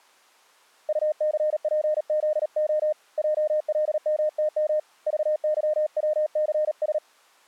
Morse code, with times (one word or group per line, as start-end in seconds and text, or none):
0.9-2.9 UCPZO
3.2-4.8 JLMTM
5.1-7.0 VYWCS